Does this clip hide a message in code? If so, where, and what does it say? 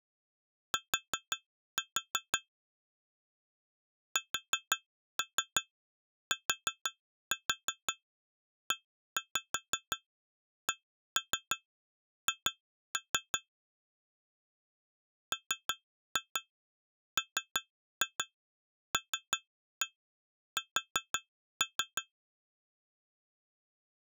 Yes: tap code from 0.7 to 22.1 s, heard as taps on glass, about 5 knocks a second. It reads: T STECH MMLS